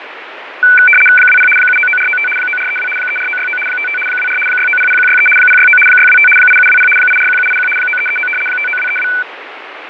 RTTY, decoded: 20 799495 9432 34969 55 24 6900163 069 625 8720 841781 9339 59232

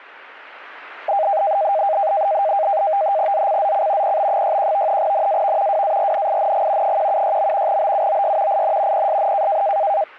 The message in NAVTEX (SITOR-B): ZCZC PB61 NAV WARNING 176. BUOY IN PSN

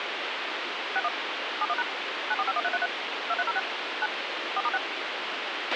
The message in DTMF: 61 71# 9451333 2306 9 4*6

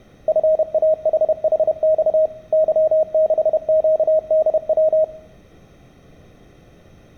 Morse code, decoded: FAHHX Y6QDW

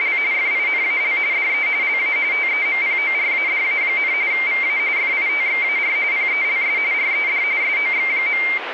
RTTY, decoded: … FINAL DE LA TEMPORADA, VA FITXAR PELS RED SOX.

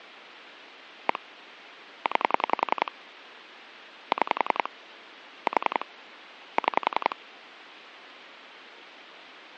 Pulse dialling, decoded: 1 9 6 4 6

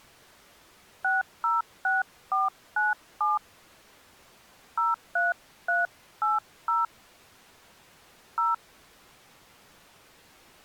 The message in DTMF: 606497 03380 0

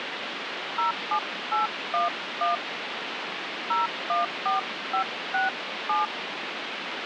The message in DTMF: 07811 014567

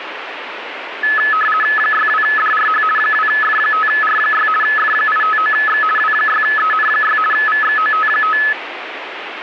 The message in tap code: none

